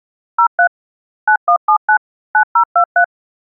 DTMF, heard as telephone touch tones, dialled by machine, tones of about 80 ms. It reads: 03 9179 9023